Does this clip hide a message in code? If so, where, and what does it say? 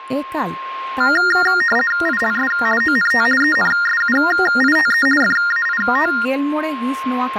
Yes: RTTY (50 baud, 450 Hz shift) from 1.0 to 6.3 s, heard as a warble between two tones, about 1650 Hz centre, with a steady whistle near 1060 Hz and speech in Santali. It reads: ILS ONT ENSUITE FAIT